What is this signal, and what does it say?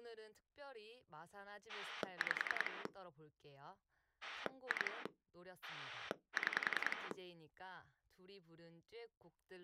Pulse dialling, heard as a rotary dial, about 10 pulses a second, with speech in Korean. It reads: 5 2 6